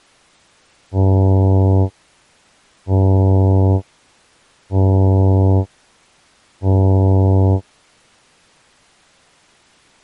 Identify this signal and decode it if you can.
Ship horn signal, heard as a ship's horn, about 100 Hz. 4 short. At sea: a pilot vessel's identity signal in fog.